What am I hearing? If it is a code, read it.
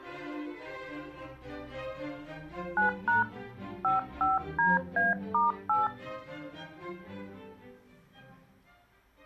DTMF, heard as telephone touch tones, dialled by hand, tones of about 150 ms. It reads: 9# 55DA*8